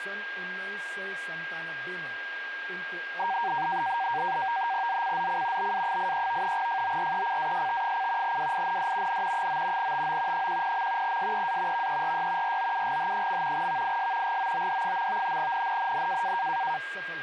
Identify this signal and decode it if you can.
NAVTEX (SITOR-B), 100 baud, 170 Hz shift, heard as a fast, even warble, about 850 Hz centre, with radio static, a steady whistle near 1610 Hz and speech in Nepali. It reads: ZCZC BA83 FORECAST: WIND N 9 TO 10. SEA VERY ROUGH. VIS GOOD. NNNN